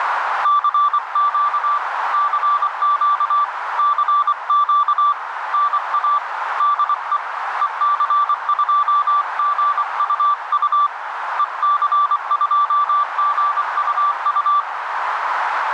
Morse code, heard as a keyed tone, hand-sent with a paddle, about 24 wpm, 1170 Hz, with radio static and a narrow filter. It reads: CQ CQ CQ NA DE EC2GUU EC2GUU